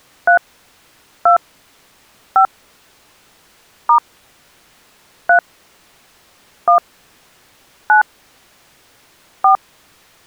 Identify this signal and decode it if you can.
DTMF, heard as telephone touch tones, dialled by hand, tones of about 110 ms. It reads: 3 2 5 * 3 1 9 4